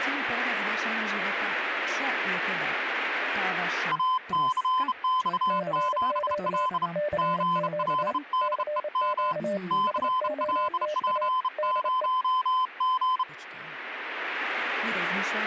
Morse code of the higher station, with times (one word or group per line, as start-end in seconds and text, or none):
3.9-6.9 ACX7L
7.2-9.3 GLDEM
9.7-13.2 CLP0G